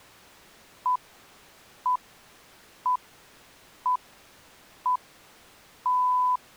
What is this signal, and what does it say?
Radio time signal (six pips, as the Greenwich Time Signal), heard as pips.